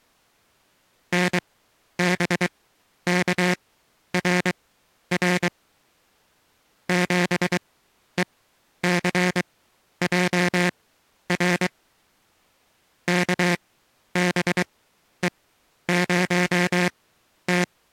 Morse code, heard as a buzzer, machine-sent, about 23 wpm, spaced as for 11 wpm. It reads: NBKRR 7ECJR KBE0T